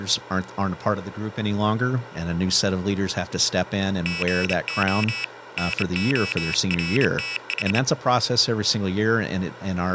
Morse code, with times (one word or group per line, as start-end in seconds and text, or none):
4.1-5.2 GO
5.6-7.8 NORTH